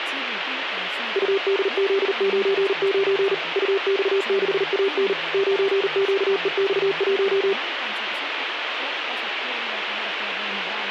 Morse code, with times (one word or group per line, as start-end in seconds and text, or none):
1.2-3.3 UDZ99
3.6-5.1 UX6AN
5.3-7.5 9QEX1